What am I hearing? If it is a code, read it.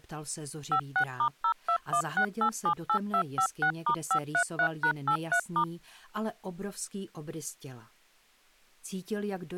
DTMF, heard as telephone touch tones, dialled by machine, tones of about 80 ms. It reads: 56*0216878256*533#83*